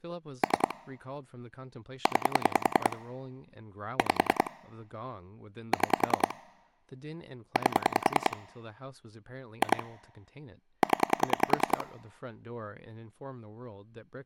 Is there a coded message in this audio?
Yes: pulse dialling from 0.4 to 11.8 s, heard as clicks on a phone line, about 10 pulses a second, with speech in English. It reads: 3 9 5 6 8 2 0